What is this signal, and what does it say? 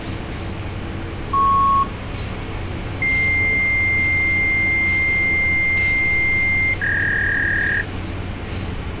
Fax machine handshake, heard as a beep, a long tone and a warble, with phone line noise and street noise.